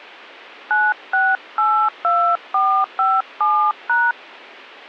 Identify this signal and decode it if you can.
DTMF, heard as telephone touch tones, dialled by hand, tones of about 220 ms. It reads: 9682457#